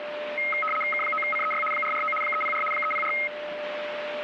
RTTY (75 baud, 850 Hz shift), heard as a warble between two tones, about 1700 Hz centre, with radio static and a steady whistle near 600 Hz. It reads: K9CEY 449 304 304